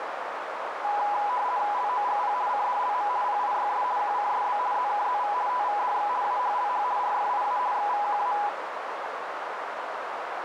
RTTY (50 baud, 170 Hz shift), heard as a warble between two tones, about 910 Hz centre, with radio static and a narrow filter. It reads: LOGP CDLM PIYS QCSB ZKZV TVDX AHLH RFIA XVQA